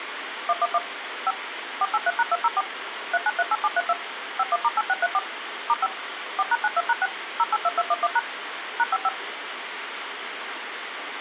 DTMF, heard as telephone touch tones, dialled by machine, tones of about 40 ms, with phone line noise. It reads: 111 5 483#204 3938732 51*8634 *5 4#92#6 082211# #55